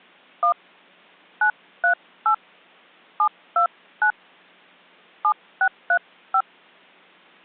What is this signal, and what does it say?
DTMF, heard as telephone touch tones, dialled by hand, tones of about 80 ms. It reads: 1 938 729 7635